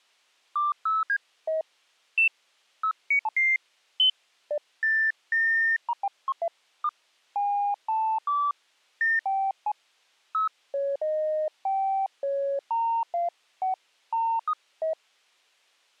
Electronic bleeps of random pitch and length. There is no code.